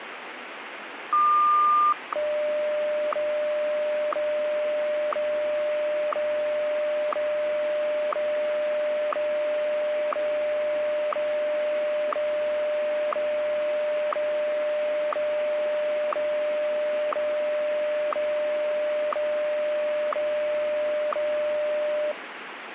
Radio time signal (WWVH, Hawaii), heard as ticks, one a second, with radio static.